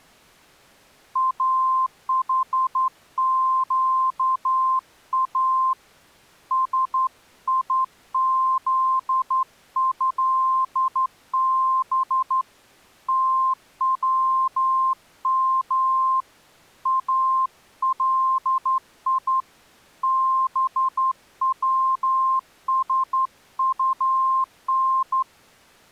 Morse code (Arabic alphabet), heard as a keyed tone, hand-sent with a straight key, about 11 wpm, 1050 Hz. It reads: احقا سيذهب توم الي بوسطن